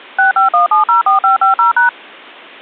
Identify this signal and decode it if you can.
DTMF, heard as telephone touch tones, dialled by machine, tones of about 130 ms. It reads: 651704550#